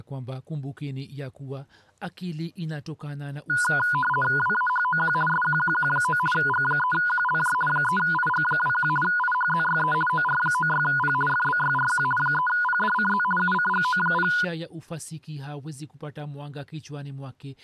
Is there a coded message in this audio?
Yes: RTTY (50 baud, 450 Hz shift) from 3.5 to 14.4 s, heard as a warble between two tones, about 1230 Hz centre, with speech in Swahili. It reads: WAHOQ SQQQ9 G3QLJ 3IG21 IHZYE OR96P FBYRQ 3PDCZ UCGO0